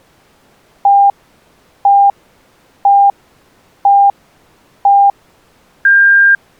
Radio time signal (five pips and a higher one, as on Chinese radio), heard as pips.